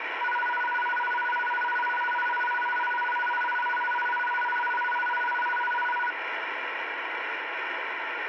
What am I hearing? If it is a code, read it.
A tone that alternates evenly between two pitches, with radio static. There is no code.